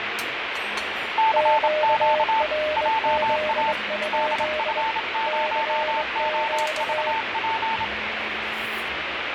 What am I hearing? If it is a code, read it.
Morse code, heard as two keyed tones, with radio static and the noise of a restaurant. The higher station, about 27 wpm, 890 Hz: CQ JA DF0OVP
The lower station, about 21 wpm, 610 Hz: QRZ? CQ